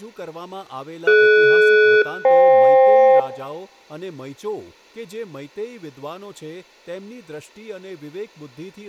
Aircraft SELCAL, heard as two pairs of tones, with room echo and speech in Gujarati. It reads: DS-FK